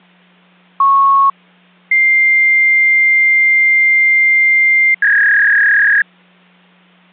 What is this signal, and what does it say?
Fax machine handshake, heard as a beep, a long tone and a warble, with hum.